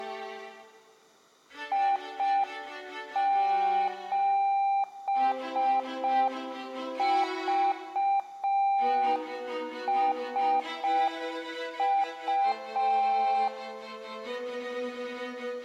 Morse code, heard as a keyed tone, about 5 wpm, 790 Hz, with room echo. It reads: I7VSU